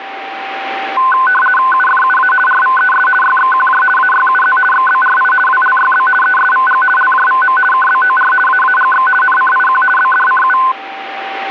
RTTY (50 baud, 450 Hz shift), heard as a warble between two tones, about 1270 Hz centre, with a steady whistle near 780 Hz. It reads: UFUA RVES YXQJ AYUZ XBRI WLYB ESVG LJVM KBOR AAGX NCIQ BDCU